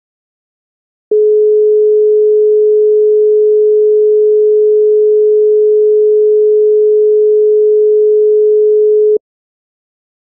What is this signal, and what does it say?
Telephone call progress tone (425 Hz plan, as in most of Europe), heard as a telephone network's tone, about 420 Hz. Dial tone.